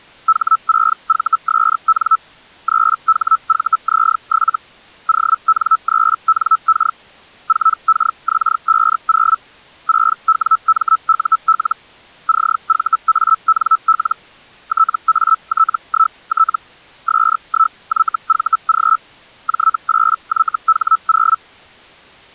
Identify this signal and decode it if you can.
Hellschreiber (Feld-Hell, 122.5 baud), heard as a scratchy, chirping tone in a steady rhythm, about 1310 Hz. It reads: H6VSN 3HVZ7 ON3NK 4KX50 6WMUL CVANL TAT1T S1YVG J8YH0